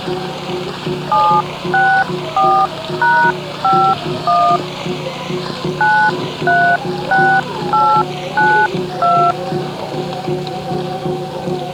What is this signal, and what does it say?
DTMF, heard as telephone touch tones, dialled by hand, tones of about 290 ms. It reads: 764#51 936892